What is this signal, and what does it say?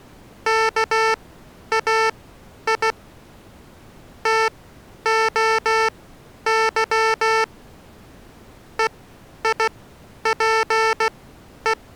Morse code (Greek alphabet), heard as electronic beeps, machine-sent, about 16 wpm, spaced as for 10 wpm, 440 Hz. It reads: ΚΑΙ ΤΟΥ ΕΙΠΕ